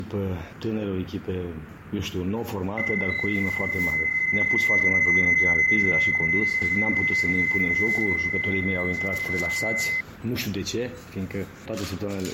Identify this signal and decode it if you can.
PSK31 (31.25 baud), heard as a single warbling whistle, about 2050 Hz, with fading.